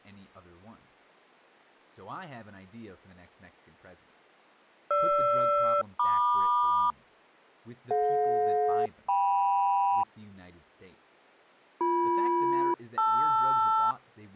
Aircraft SELCAL, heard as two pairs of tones, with speech in English. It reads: GR-MQ DJ-KM BM-LR